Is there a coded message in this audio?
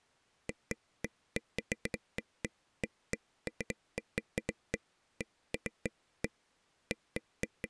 No, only irregular taps on a table.